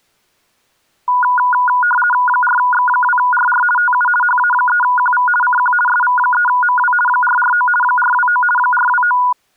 RTTY (50 baud, 450 Hz shift), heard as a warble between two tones, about 1220 Hz centre. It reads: 4X2RR TU HA3QV CQ SV3MW 449 429 429